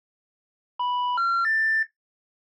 Telephone call progress tone (North American plan), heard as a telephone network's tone, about 980, 1370, 1800 Hz. Special information tone.